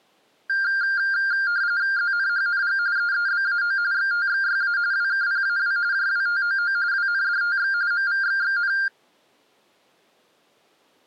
RTTY (45.45 baud, 170 Hz shift), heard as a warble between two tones, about 1500 Hz centre. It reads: ZNHNG EEBAO XTXYA WKPAW JWTOO WNDTX MVXXN